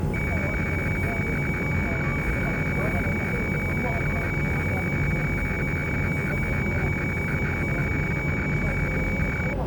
Weather fax (radiofax), 120 lines a minute, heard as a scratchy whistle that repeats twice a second, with a steady whistle near 850 Hz and the noise inside a subway train.